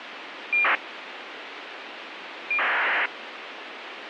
ACARS aircraft data, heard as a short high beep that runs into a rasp, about 2400 baud, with radio hiss and a squelch burst at the end.